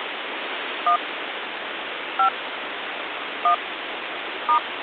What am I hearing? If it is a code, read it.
DTMF, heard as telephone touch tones, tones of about 100 ms, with phone line noise. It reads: 1 5 1 *